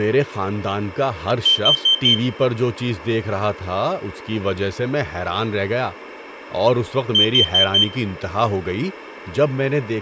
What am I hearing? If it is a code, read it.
Alarm pattern, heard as an alarm's beeps, played twice, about 3100 Hz, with room echo and speech in Urdu. Temporal four. Carbon monoxide.